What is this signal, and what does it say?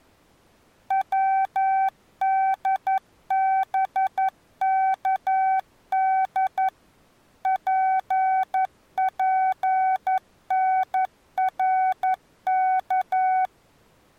Morse code, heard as a keyed tone, machine-sent, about 11 wpm, 760 Hz. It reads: WDBKD PPNRK